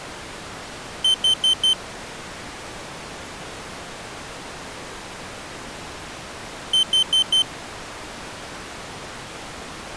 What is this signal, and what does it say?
Alarm pattern, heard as an alarm's beeps, played twice, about 3100 Hz. Temporal four. Carbon monoxide.